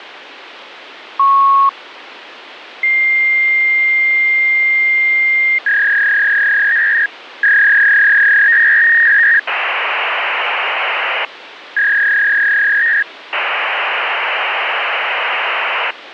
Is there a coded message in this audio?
Yes: fax machine handshake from 1.2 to 15.9 s, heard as a beep, a long tone, a warble and hiss, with phone line noise.